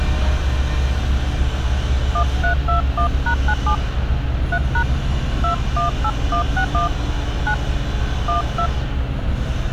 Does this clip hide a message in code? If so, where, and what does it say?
Yes: DTMF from 2.1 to 8.7 s, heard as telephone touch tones, dialled by hand, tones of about 100 ms, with street noise. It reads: 1321#97 3# 218161 9 12